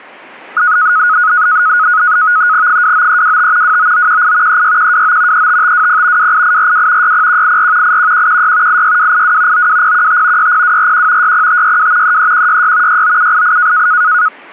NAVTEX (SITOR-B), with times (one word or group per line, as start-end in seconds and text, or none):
2.7-3.8 29325
3.6-4.6 29918
4.5-5.5 36129
5.3-6.3 35520
6.2-7.1 28842
7.0-8.0 60184
7.8-8.8 81116
8.7-9.7 86282
9.5-10.5 92015
10.4-11.3 60241
11.2-12.2 60562
12.0-13.0 33166
12.9-13.9 69788